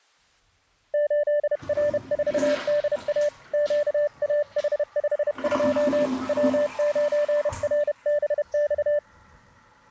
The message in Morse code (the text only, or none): 8R4DA QAH52 W9RBX